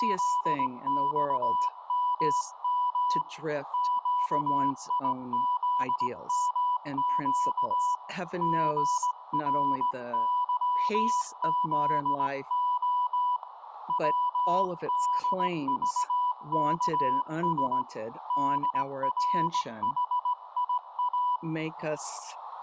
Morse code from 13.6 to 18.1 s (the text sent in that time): WDVKS